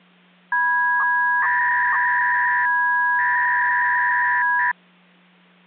300-baud modem data (V.21 tones), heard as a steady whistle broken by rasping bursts, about 300 baud, 200 Hz shift, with hum.